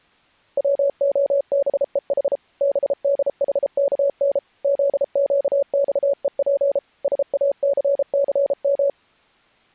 Morse code, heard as a keyed tone, machine-sent, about 33 wpm, 560 Hz. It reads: WOBEH BDHKN ZQXEP SACCM